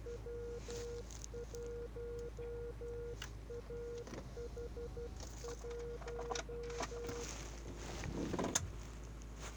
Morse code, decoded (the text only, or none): W1AH1